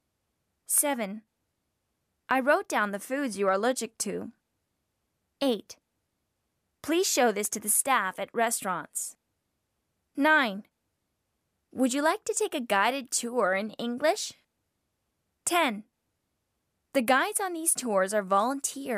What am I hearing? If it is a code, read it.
Speech in English. There is no code.